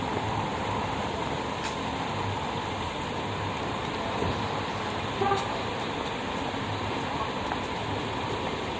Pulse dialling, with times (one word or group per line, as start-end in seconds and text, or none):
none